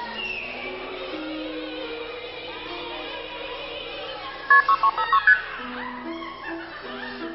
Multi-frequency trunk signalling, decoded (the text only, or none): KP 6356 ST